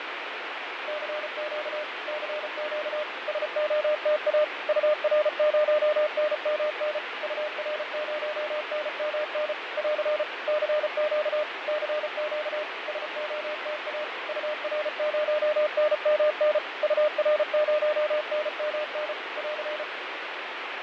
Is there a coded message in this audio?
Yes: Morse code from 0.8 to 19.9 s, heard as a keyed tone, machine-sent, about 34 wpm, 600 Hz, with radio static and fading. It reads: CQ CQ SOTA UR0NMN UR0NMN <AR> CQ CQ SOTA UR0NMN UR0NMN <AR>